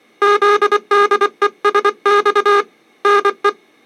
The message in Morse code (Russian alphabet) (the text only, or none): ЗДЕСЬ НЕ